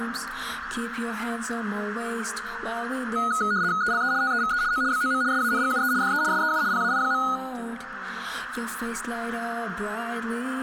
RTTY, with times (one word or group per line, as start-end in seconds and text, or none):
3.8-4.1 ELE
4.2-4.6 TEVE
4.7-4.8 O
4.9-5.2 BOM
5.3-5.9 SANGUE
6.0-6.2 DE
6.3-6.6 SEU
6.7-7.2 PAI.